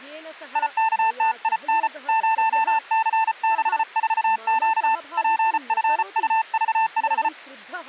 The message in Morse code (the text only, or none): IKTIN 0C64Q PFUV5